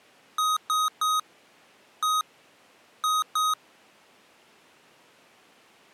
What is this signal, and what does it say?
Beep code, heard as beeps from a small speaker, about 1260 Hz. 3-1-2. In Phoenix BIOS tables: DMA register failure.